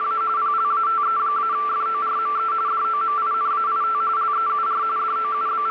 RTTY (45.45 baud, 170 Hz shift), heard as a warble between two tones, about 1250 Hz centre, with radio static and a steady whistle near 440 Hz. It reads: … PLATE-FORME DOMINAIT LEUR …